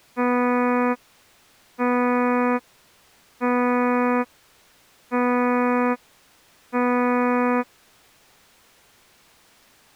Ship horn signal, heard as a ship's horn, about 250 Hz. 5 short. At sea: I doubt that you are doing enough to avoid a collision.